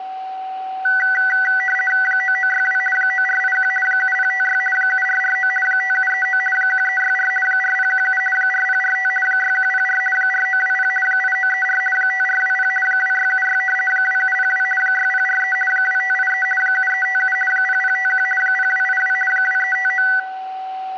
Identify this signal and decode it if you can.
RTTY (50 baud, 450 Hz shift), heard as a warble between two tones, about 1750 Hz centre, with a steady whistle near 760 Hz. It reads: 9962 9481 7056 7449 5739 1364 4017 4045 6104 4920 8934 5420 2676 2702 6043 2583 7357 0051 0282 2359